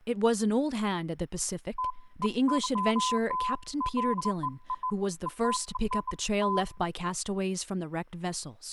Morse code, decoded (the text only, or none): none